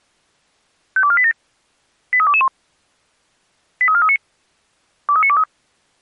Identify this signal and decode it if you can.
Five-tone selective call (ZVEI), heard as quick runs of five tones, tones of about 70 ms. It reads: 52487 83221 83439 23923